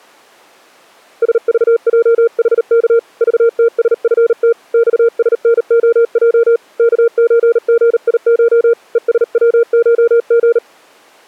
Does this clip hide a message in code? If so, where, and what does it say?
Yes: Morse code (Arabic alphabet) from 1.2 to 10.6 s, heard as a keyed tone, hand-sent with a paddle, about 38 wpm, 460 Hz. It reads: سضجحك ضتسفت صسنخج كزغيش ءسوشغ